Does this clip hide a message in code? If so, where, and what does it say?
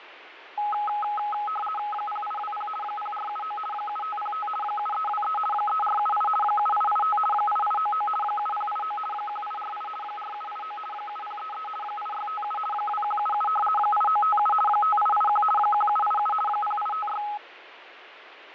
Yes: RTTY (50 baud, 450 Hz shift) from 0.6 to 17.4 s, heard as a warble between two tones, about 1060 Hz centre, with radio static and fading. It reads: 0820 0479 7505 7323 3478 7885 8899 7089 1848 4789 7033 8657 2177 8957 5881 1787 0856